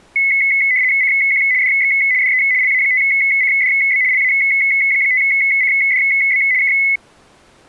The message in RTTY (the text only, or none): CQ DX DE LA5CDB LA5CDB K